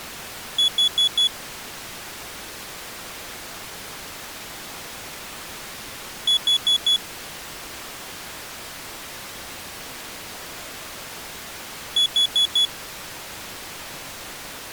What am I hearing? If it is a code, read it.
Alarm pattern, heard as an alarm's beeps, played three times, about 3400 Hz. Temporal four. Carbon monoxide.